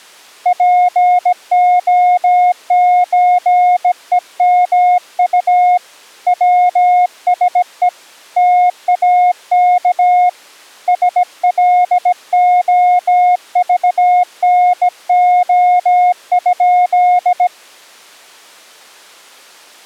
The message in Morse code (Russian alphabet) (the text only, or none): ПОЧЕМУ ВСЕ ТАК СЛОЖНО?